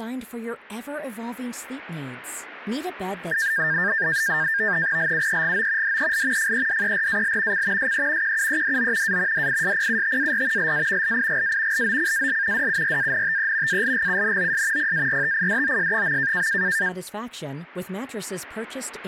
NAVTEX (SITOR-B), 100 baud, 170 Hz shift, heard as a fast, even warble, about 1700 Hz centre, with speech in Swedish. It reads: LUEGO DEL FEDERAL C SE QUEDO A DISPUTAR LA LIGA LOCAL DURANTE ALGUNOS PARTIDOS.